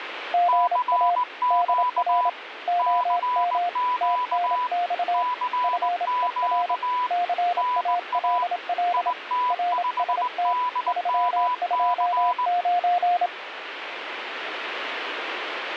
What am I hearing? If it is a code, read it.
Morse code, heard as two keyed tones, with radio static. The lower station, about 27 wpm, 710 Hz: GA DR OM TNX FER CALL RST 329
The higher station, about 19 wpm, 990 Hz: CQ CQ CQ NA IT5DMC